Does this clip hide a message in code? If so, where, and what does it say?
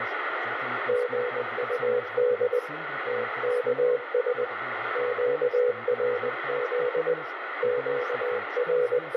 Yes: Morse code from 0.8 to 9.2 s, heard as a keyed tone, hand-sent with a paddle, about 20 wpm, 490 Hz, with radio static, room echo and speech in Portuguese. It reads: GUD TKS QRZ …